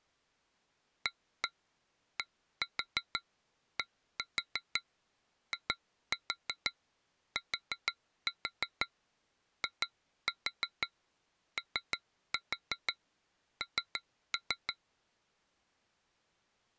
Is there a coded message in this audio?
Yes: tap code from 1.1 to 14.8 s, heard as taps on glass, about 6 knocks a second. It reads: ADDITION